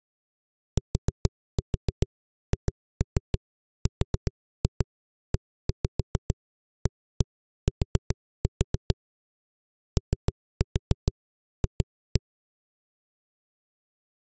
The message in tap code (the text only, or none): THREAT OF